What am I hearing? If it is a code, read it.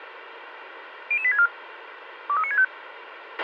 Five-tone selective call (ZVEI), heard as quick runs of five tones, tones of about 70 ms, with radio hiss and a squelch burst at the end. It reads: 00864 23965